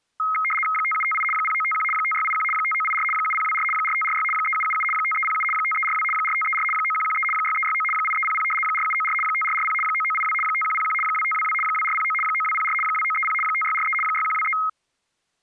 RTTY (75 baud, 850 Hz shift), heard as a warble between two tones, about 1700 Hz centre. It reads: 5758 0951 5681 5984 7024 4546 3777 5307 5342 4534 9113 6369 8300 4794 5440 9982 5101 2522 2409 9204 2930 5643 6123